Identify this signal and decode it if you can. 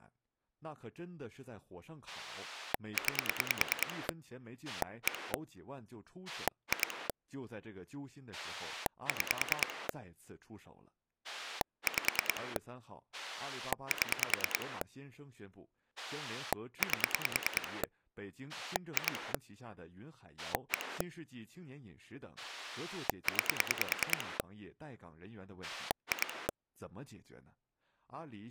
Pulse dialling, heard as a rotary dial, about 9 pulses a second, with speech in Chinese. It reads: 9 1 2 6 5 7 8 2 1 9 2